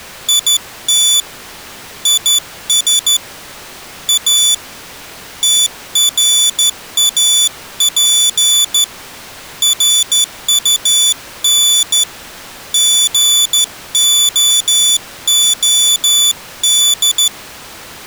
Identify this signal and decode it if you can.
Morse code, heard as a high beeper, hand-sent with a straight key, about 13 wpm, 3500 Hz. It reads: IT IS A TRAP RUN GOOD